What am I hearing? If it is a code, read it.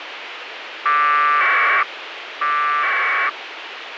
Packet radio (AX.25, as in APRS), 1200 baud, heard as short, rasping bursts, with radio hiss and a squelch burst at the end.